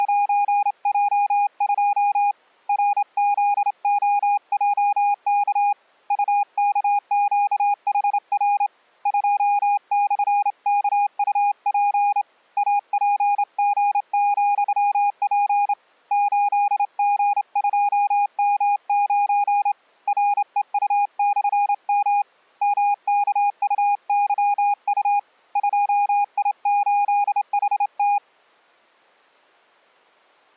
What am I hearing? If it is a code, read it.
Morse code, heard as a keyed tone, hand-sent with a straight key, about 28 wpm, 820 Hz. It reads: … RZOJK UKQHR 2/KUP APG,P 8G2M9 REU/M MKUYU 2I8HT